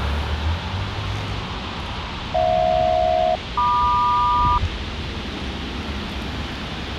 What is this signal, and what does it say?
Aircraft SELCAL, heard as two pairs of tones, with radio hiss and the noise of a residential street. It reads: HJ-MQ